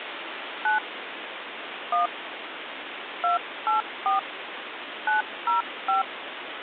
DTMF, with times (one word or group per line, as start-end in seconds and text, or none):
0.7-0.8 9
1.9-2.1 1
3.2-4.2 284
5.1-6.0 905